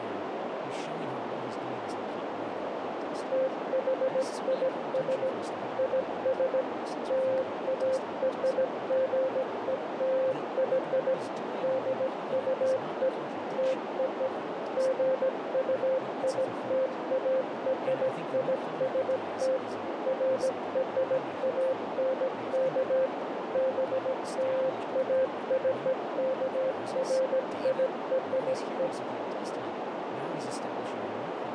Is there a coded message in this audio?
Yes: Morse code (American railroad code) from 3.3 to 28.9 s, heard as a keyed tone, machine-sent, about 520 Hz, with heavy radio static, a narrow filter and speech in English. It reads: THIS IS LARGELY DUE TO GUITARIST FRANK BLACKFIRE